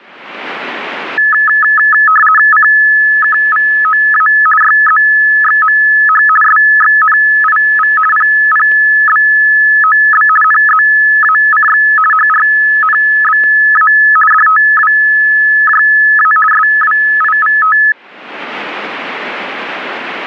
RTTY (50 baud, 450 Hz shift), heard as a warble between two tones, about 1500 Hz centre, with static crashes. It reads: CKVOA YZXMH SXNIV PPBOB NZACX HRNBA DTWJA SWIVT